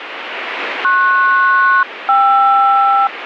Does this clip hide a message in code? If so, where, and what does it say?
Yes: aircraft SELCAL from 0.8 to 3.1 s, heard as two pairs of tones, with radio static. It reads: PS-KR